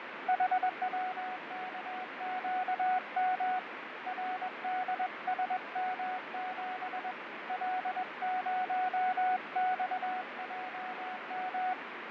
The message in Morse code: HWKQM RDSM7 L0XJM

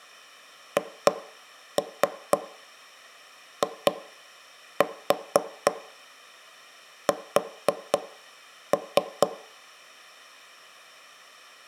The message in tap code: HIS

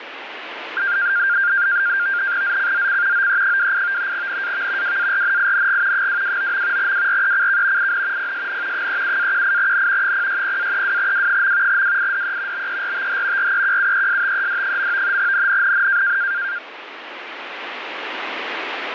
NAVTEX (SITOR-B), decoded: ZCZC OE28 NAV WARNING 229. WRECK IN PSN 37-18N 060-32W. WIDE BERTH REQUESTED. NNNN

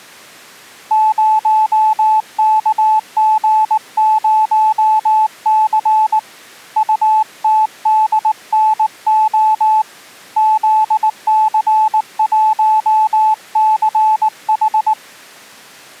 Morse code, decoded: 0KG0C UTDNO ZC1CH

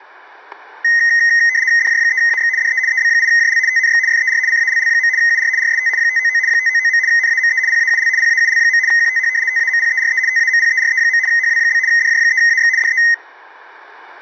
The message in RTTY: DJ3AX DE EB8JL TNX FER CALL. UR RST 599 599. NAME PAUL PAUL. QTH TAMPERE TAMPERE. HW? DJ3AX DE

